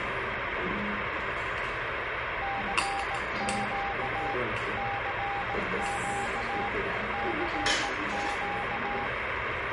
Morse code, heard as a keyed tone, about 18 wpm, 800 Hz, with radio static and the noise of a restaurant. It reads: CQ CQ CQ